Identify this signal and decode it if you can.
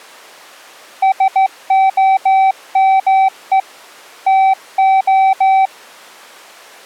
Morse code, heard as a keyed tone, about 14 wpm, 770 Hz. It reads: SOME TO